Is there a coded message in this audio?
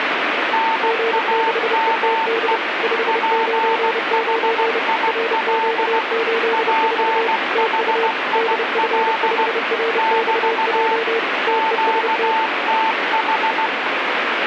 Yes: Morse code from 0.5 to 13.7 s, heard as two keyed tones, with radio static. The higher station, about 16 wpm, 890 Hz: NAME PHIL PHIL <BT> QTH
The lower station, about 30 wpm, 460 Hz: G6ETD 599 RQ84 TU DF5RXJ TEST